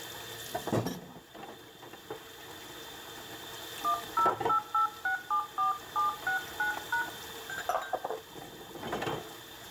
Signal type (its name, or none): DTMF